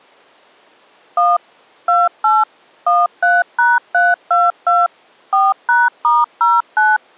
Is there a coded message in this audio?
Yes: DTMF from 1.2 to 7.0 s, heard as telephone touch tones, dialled by machine, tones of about 200 ms. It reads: 1 28 13#322 4#*09